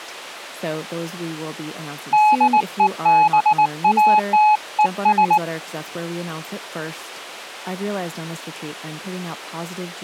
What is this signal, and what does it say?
Morse code, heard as a keyed tone, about 19 wpm, 850 Hz, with speech in English. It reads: DEBATES